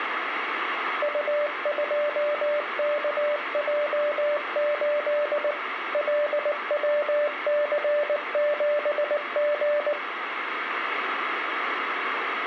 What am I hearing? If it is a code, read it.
Morse code, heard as a keyed tone, machine-sent, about 19 wpm, 590 Hz, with radio static. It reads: U2KJ8 LWC7G